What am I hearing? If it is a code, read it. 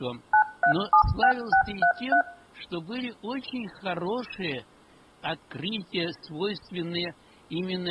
DTMF, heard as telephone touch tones, dialled by machine, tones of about 90 ms, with room echo. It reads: 9376633